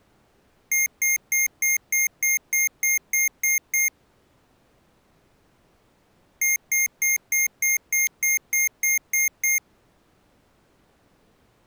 Beep code, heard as beeps from a small speaker, played twice, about 2100 Hz. 11 short. In AMI BIOS tables: cache memory error.